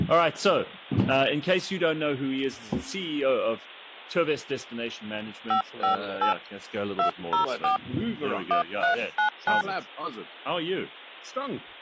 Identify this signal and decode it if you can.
DTMF, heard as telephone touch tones, dialled by hand, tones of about 110 ms. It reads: 558 204 1399